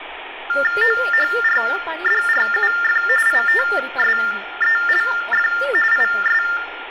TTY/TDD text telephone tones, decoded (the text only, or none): OHRDRUF ITSELF IS